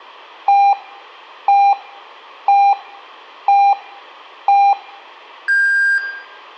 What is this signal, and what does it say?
Radio time signal (five pips and a higher one, as on Chinese radio), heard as pips, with room echo.